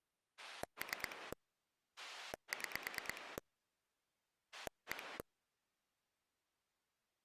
Pulse dialling, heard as a rotary dial, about 9 pulses a second. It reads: 3 6 1